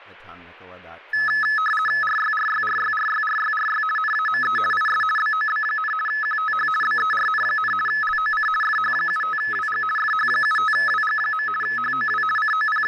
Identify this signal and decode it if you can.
RTTY (50 baud, 450 Hz shift), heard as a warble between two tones, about 1500 Hz centre, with speech in English. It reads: RYRYRYRYRYRY NAME IS BOB, QTH BERN, LOC FH75WG FH75WG. HOW …